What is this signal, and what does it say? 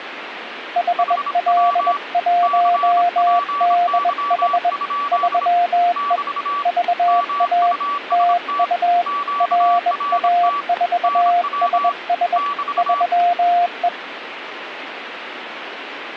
Morse code, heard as two keyed tones, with radio static. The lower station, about 21 wpm, 700 Hz: HL1DH 3E VA TU RA4SS 3E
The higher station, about 26 wpm, 1150 Hz: HW CPY? <BT> MUST QRT NW <BT>